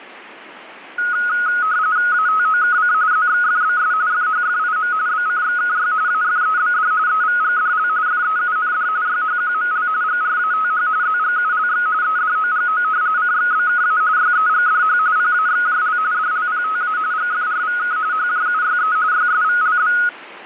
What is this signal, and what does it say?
RTTY (45.45 baud, 170 Hz shift), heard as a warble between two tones, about 1360 Hz centre. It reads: ATOKC ZXFBS FHFIM BCXKY AFEBD EVGDL FEUND YHQML GRATH ZGULX EDOGO CXBKA YEGDH PAXJL DLPTA GFRVK HJUYE YSVLB